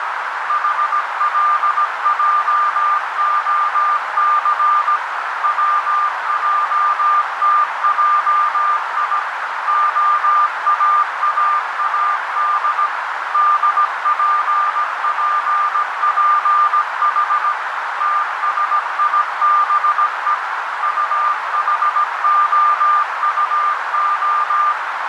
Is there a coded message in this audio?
Yes: Morse code (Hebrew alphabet) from 0.4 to 24.8 s, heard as a keyed tone, machine-sent, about 17 wpm, 1200 Hz, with heavy radio static and a narrow filter. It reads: חלעהס צעתעי האאאד דפפפח תשיבו טחהטה